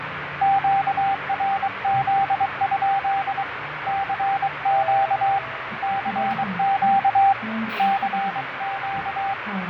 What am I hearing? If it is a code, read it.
Morse code, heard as a keyed tone, hand-sent with a paddle, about 23 wpm, 790 Hz, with radio static, fading and the noise inside a bus. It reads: QRZ? CQ CQ CQ